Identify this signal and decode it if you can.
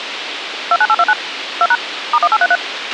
DTMF, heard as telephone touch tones, dialled by machine, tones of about 50 ms, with radio hiss and a squelch burst at the end. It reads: 29829 2# *1833